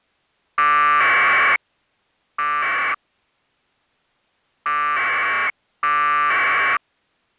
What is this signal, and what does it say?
Packet radio (AX.25, as in APRS), 1200 baud, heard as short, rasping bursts.